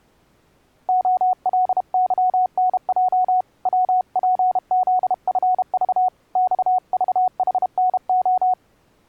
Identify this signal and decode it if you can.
Morse code, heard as a keyed tone, hand-sent with a paddle, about 32 wpm, 740 Hz. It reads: OLYNJ WPZFV XVHNO